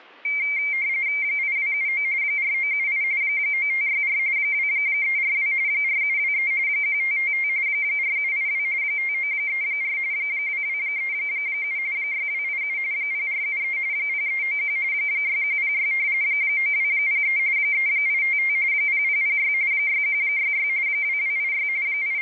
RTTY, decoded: 8279 4978 9564 2342 4723 1555 4782 5934 2237 6287 0473 0391 6106 9203 3855 0006 6166 2286 …

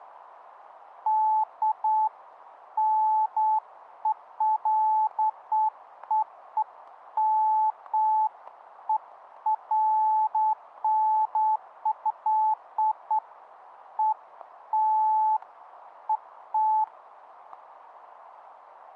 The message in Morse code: none

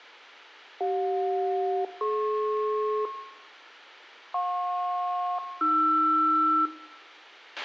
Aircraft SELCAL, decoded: CJ-DP JP-AR

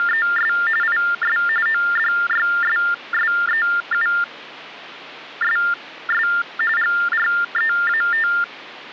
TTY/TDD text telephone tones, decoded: … IS ODYSSEUSS GREAT

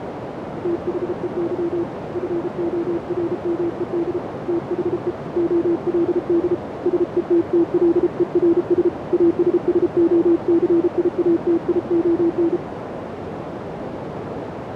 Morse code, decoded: THEY FORMED THE OLD SETTLERS ASSOCIATION

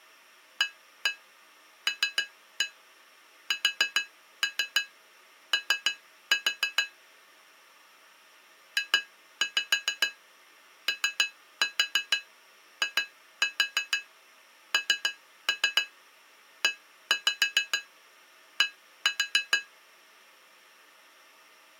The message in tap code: ALSO JOINED

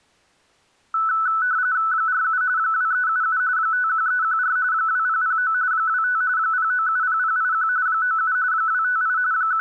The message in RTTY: 47 2377 51314 2009 25 0970081 97 258 …

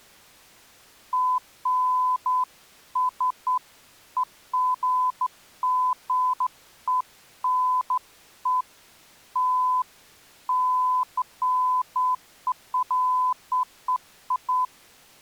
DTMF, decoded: none

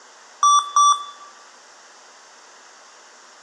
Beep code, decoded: 2 short

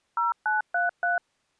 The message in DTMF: 0933

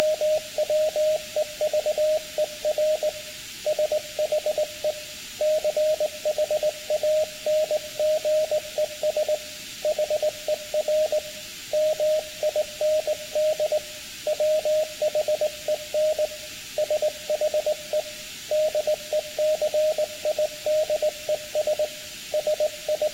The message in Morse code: … SHE CHANGES HER MIND WHEN SHE DECIDES …

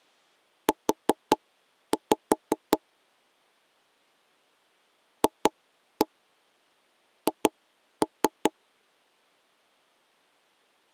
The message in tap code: U FH

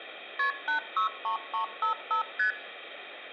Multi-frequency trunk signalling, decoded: KP 863355 ST

